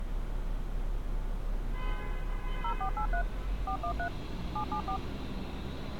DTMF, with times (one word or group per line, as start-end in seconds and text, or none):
2.6-3.2 0483
3.7-4.1 413
4.6-5.0 774